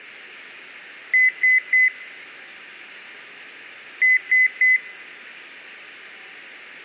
Beep code, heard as beeps from a small speaker, played twice, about 2000 Hz. 3 short. In AMI BIOS tables: failure in the first 64 KB of memory; in Dell tables: chipset error.